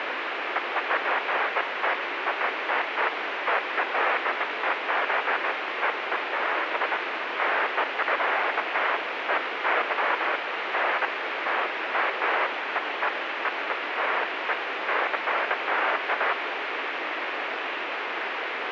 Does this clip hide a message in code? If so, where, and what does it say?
No, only bursts of noise, with heavy radio static.